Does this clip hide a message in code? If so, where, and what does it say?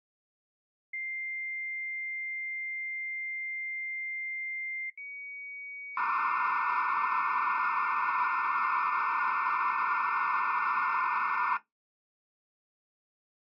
Yes: dial-up modem handshake (low-speed, two carriers) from 0.9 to 11.6 s, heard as two whistles, then hiss.